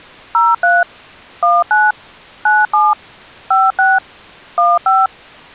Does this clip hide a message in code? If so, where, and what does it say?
Yes: DTMF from 0.3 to 5.1 s, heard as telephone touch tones, dialled by machine, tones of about 200 ms. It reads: 03 19 97 56 15